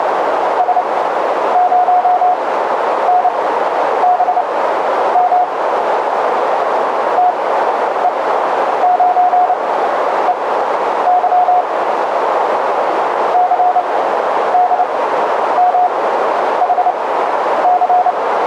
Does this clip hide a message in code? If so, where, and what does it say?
Yes: Morse code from 0.5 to 18.2 s, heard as a keyed tone, machine-sent, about 29 wpm, spaced as for 10 wpm, 720 Hz, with radio static and a narrow filter. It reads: S0NBM TE9EY CDMHC